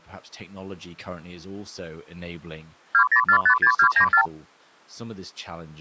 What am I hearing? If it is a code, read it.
Multi-frequency trunk signalling (R2, with the far end's replies), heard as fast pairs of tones, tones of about 80 ms, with speech in English. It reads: 20456294